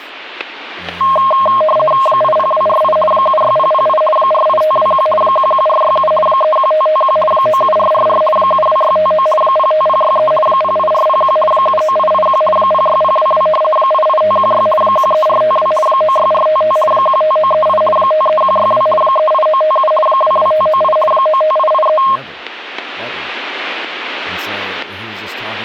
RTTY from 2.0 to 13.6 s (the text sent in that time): 80248 76008 48521 11467 31551 97444 72659 05063 08401 79881 06022